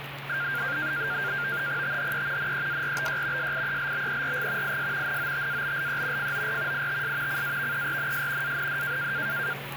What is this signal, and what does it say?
NAVTEX (SITOR-B), 100 baud, 170 Hz shift, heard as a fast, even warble, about 1500 Hz centre, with radio static and the noise of a restaurant. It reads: THE NEARBY SIELBERG IS NOTABLE FOR ITS CAVERNS AND